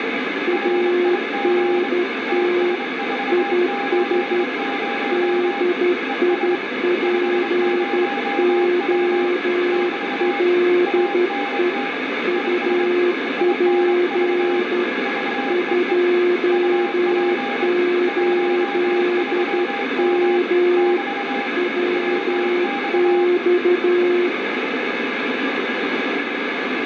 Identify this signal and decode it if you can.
Morse code, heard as two keyed tones, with heavy radio static. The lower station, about 12 wpm, 360 Hz: ANT IS DIPOLE UP 28M WX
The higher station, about 25 wpm, 800 Hz: RIG TS480 ES 50W <BT> ANT IS INV VEE UP 13M <BT> WX